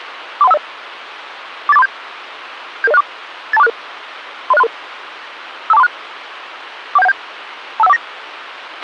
Five-tone selective call (EIA), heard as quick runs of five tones, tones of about 30 ms, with radio hiss and a squelch burst at the end. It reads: 43150 48437 77064 82466 30633 52436 41717 25149